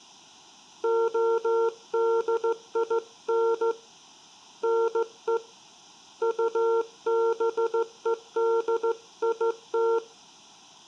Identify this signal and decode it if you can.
Morse code (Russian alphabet), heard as a keyed tone, hand-sent with a straight key, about 15 wpm, 460 Hz, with room echo. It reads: ОДИН НЕ УБЕДИТ